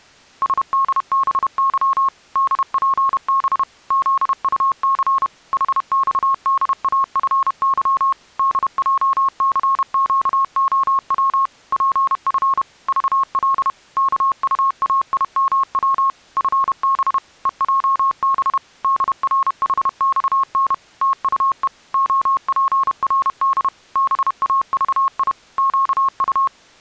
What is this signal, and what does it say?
Morse code, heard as a keyed tone, machine-sent, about 31 wpm, 1080 Hz. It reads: SDBY DPB ZUC HXDAFY DJCQOW PF VL KUAIMW FB EJB DRHXN TUE OPRD BAVI QU